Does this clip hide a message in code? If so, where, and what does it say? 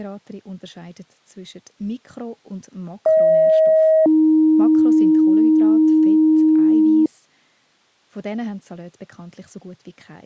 Yes: two-tone page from 3.1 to 7.1 s, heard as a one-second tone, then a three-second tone, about 630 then 310 Hz, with speech in German.